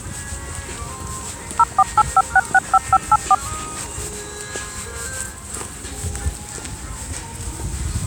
DTMF, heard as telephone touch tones, dialled by machine, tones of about 40 ms, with the noise of a residential street. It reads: 0485665584